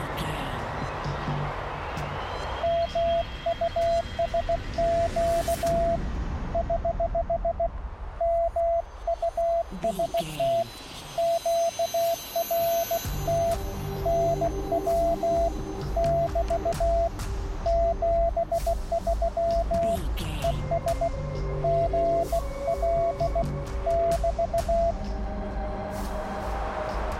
Morse code, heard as a keyed tone, hand-sent with a bug key, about 16 wpm, 680 Hz, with radio static. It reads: MUSQ <HH> MUST QRT NW <BT> 73 ES GL <BT>